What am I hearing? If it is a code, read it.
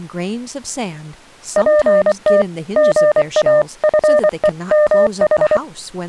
Morse code (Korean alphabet), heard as a keyed tone, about 24 wpm, 600 Hz, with speech in English. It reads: 저 소나무